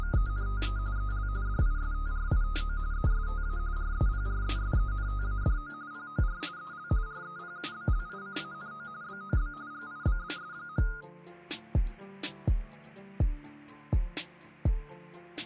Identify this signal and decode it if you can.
RTTY (45.45 baud, 170 Hz shift), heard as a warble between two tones, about 1340 Hz centre. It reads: … EL DISTRITO ESTA REPRESENTADO POR EL REPUBLICANO BOB GIBBS.